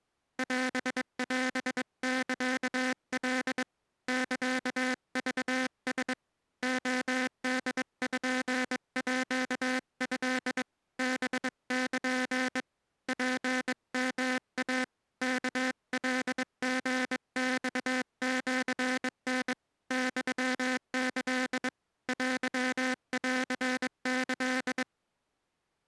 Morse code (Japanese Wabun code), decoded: オオサカ サクラ レポート ハル ツヨイ ワカリマシタ ユキ テンキ

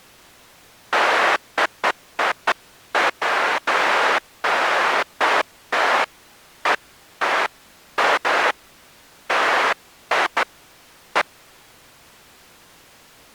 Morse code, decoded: none

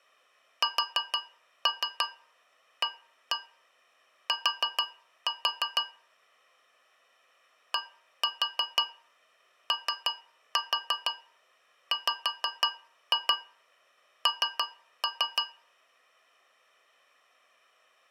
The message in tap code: SAT DOWN

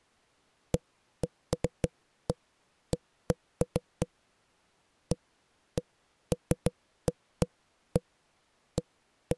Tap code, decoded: none

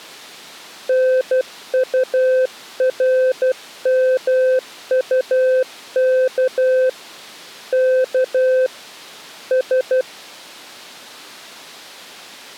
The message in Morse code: NURMUK K S

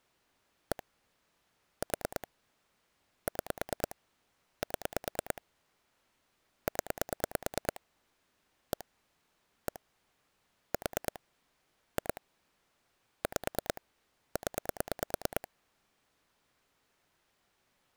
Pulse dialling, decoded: 1 4 6 7 0 1 1 4 2 5 0

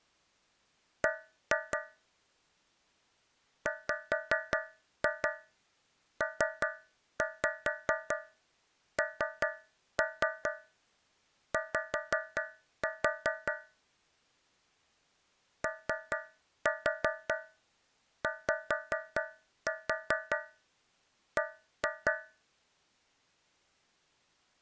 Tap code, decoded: B WPNY OYB

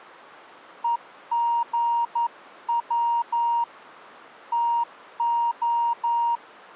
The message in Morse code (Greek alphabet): ΕΓΩ ΤΟ

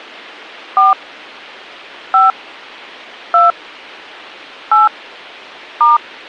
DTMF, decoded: 4 5 2 8 *

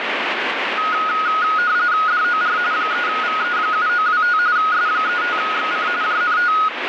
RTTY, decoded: DOR 3VE7925 S35XC JNT

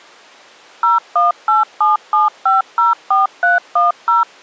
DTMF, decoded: 01877504310

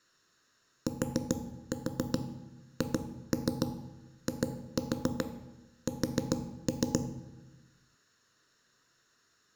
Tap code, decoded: THIS

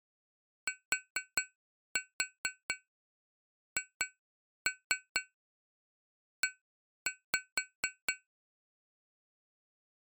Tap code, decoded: THE

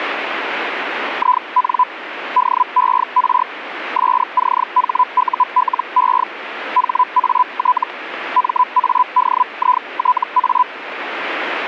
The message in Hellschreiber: IN DER SCHULE HAT MADITA

